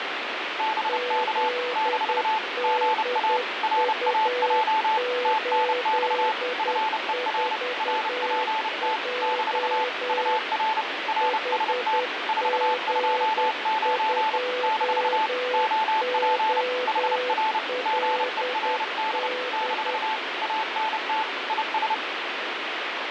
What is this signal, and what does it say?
Morse code, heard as two keyed tones, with radio static. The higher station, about 30 wpm, 880 Hz: BK - GA RAJ TNX FER RPT - UR RST 429 - OP HR GERD - ANT IS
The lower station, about 10 wpm, 500 Hz: ZDU84J HG2OLD